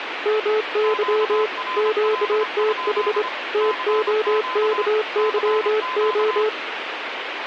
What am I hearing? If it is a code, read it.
Morse code, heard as two keyed tones, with radio static. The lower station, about 25 wpm, 430 Hz: MY QTH TOKYO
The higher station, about 26 wpm, 1020 Hz: QRL? CQ CQ